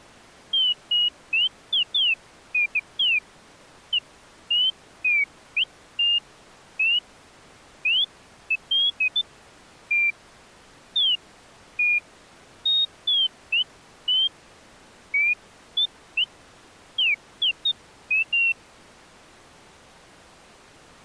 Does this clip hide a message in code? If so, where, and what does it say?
No, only bird-like chirps.